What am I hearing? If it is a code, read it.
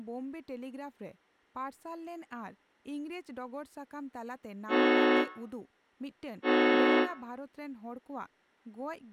Train horn signal, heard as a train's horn, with room echo and speech in Santali. 2 short. On North American railways: a signal is acknowledged.